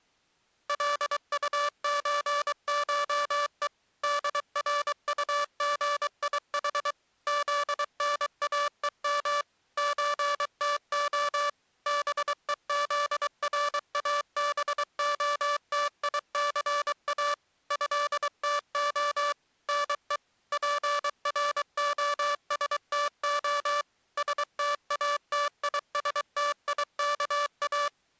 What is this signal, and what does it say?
Morse code (Russian alphabet), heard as a buzzer, machine-sent, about 23 wpm. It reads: ЛУЧШЕ ДРУГИХ ЗНАЕМ ЧТО БЕЗРАБОТИЦА ЭТО НЕ ПРОСТО СТАТИСТИКА